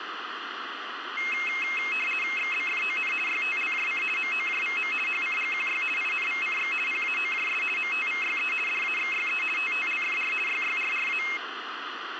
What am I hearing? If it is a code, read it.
RTTY (50 baud, 450 Hz shift), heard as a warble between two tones, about 2350 Hz centre, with radio static. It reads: XBFON YTLJC MOJVM HCGQY INVCX PAOJS MTVYE DAXYE TTLFR YYRRA